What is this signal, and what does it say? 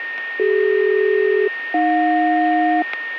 Aircraft SELCAL, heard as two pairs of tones, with a steady whistle near 1840 Hz. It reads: CD-AJ